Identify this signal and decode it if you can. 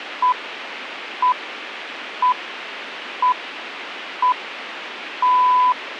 Radio time signal (six pips, as the Greenwich Time Signal), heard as pips, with radio hiss.